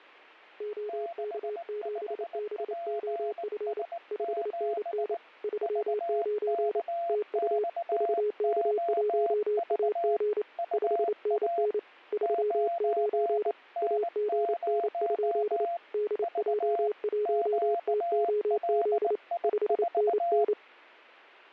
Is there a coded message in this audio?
Yes: Morse code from 0.5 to 20.6 s, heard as two keyed tones, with fading. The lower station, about 28 wpm, 420 Hz: OK7BOF 5NN 39 TU VK1AG 5NN 39 AGN? DJ1TOZ 5NN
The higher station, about 19 wpm, 680 Hz: 65PS7 VKXOV UA 9N0 V QLI4